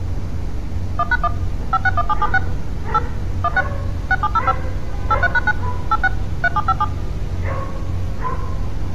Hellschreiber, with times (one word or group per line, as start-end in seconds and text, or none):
none